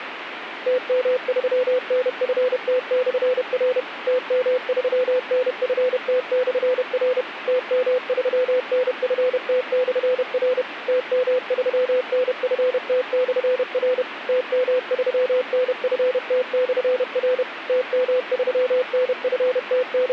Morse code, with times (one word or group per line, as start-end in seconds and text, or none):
0.7-3.8 TM3NFT/R
4.1-7.2 TM3NFT/R
7.5-10.6 TM3NFT/R
10.9-14.0 TM3NFT/R
14.3-17.4 TM3NFT/R
17.7-20.1 …